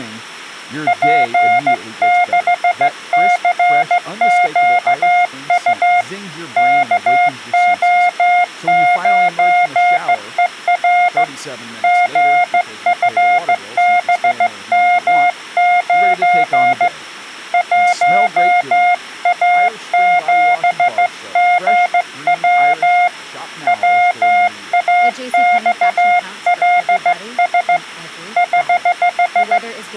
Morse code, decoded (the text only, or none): P6CQU KO9ER GFBM9 1A7GW WAXLS <HH>